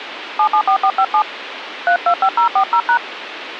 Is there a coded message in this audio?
Yes: DTMF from 0.4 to 3.0 s, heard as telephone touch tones, dialled by hand, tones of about 80 ms, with phone line noise. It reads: 774457 325040#